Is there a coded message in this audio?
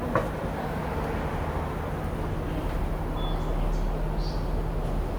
No, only the noise of a subway station.